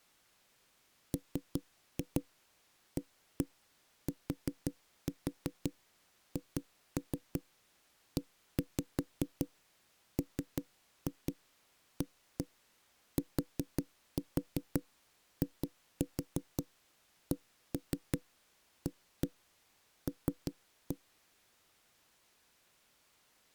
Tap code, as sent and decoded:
3-2 1-1 4-4 2-3 1-5 3-2 1-1 4-4 2-4 1-3 1-1 3-1
MATHEMATICAL

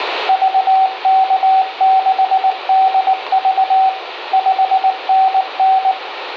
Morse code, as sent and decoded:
...- -.- -.... -.. ...- / ..... -. -.
VK6DV 5NN

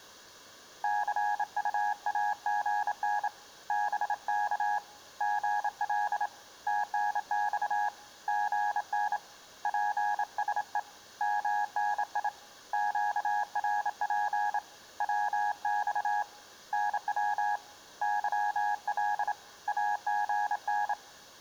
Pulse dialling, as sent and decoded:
none

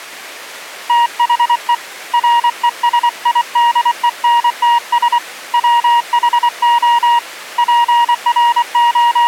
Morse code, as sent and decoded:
- .... . / .-. . ... .. -.. . -. - ... / .-- .... --- / …
THE RESIDENTS WHO …

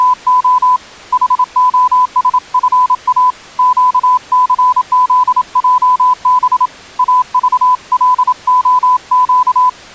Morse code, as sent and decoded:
… / .... --- ... ..-. .- / --.- -.-. --.. .--- -... / .- ...- .-.. --- --.-
… HOSFA QCZJB AVLOQ

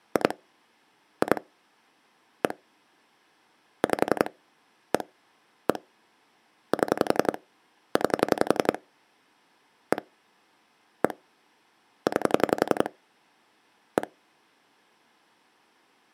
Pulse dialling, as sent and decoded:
2 / 2 / 1 / 5 / 1 / 1 / 7 / 9 / 1 / 1 / 9 / 1
2 2 1 5 1 1 7 9 1 1 9 1

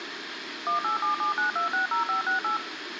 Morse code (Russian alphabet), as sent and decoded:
none

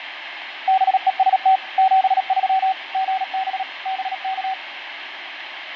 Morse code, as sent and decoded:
-... . ... - / --... ...-- / --. -... / -... -.-
BEST 73 GB BK

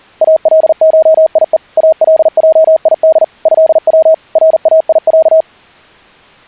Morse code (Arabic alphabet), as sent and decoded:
.- .-.. ---- .. . / .- .-.. .--- .. -.. / ..-.. .-- / .-. .- .. .-.-
الشيء الجيد هو رايع

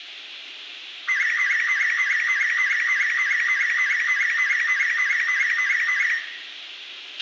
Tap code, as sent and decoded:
none

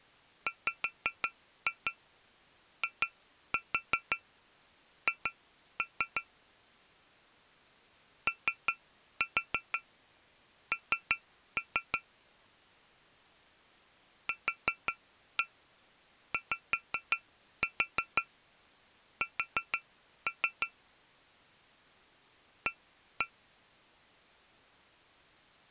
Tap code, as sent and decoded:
5-2 2-4 2-3 / 3-4 3-3 / 4-1 5-4 4-3 / 1-1
WIH ON QYS A

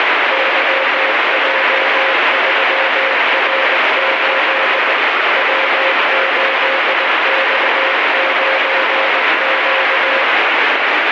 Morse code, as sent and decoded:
-.-- .--- ...-- .-. ---.. / .-- ---.. -..- ----. --.-
YJ3R8 W8X9Q

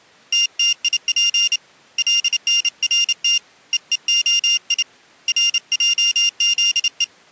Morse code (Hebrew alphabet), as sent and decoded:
- - .. .--. / .-.. -. .-. - / . . --- .. / .-. .--- --.. .
תתיף לנרת ווהי רעזו

